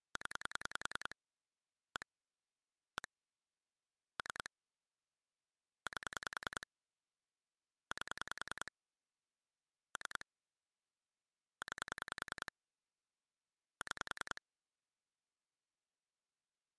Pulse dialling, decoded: 0 1 1 3 8 8 3 9 6

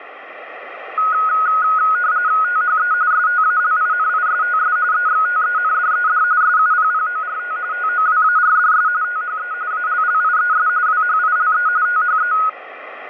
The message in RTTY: THE STALINISTS EXTENDED SUPPORT TOWARDS THE ALLIES WHILE THE

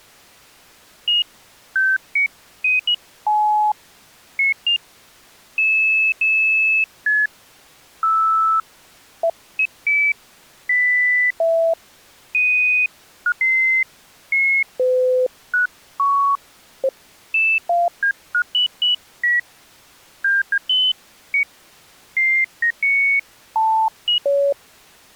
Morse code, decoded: none

